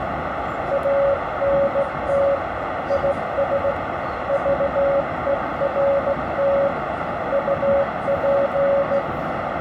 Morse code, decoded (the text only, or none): ANT IS VERT UP